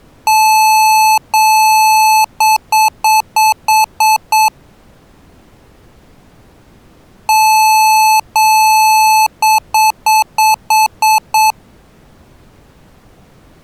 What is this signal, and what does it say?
Beep code, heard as beeps from a small speaker, played twice, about 870 Hz. 2 long, 7 short.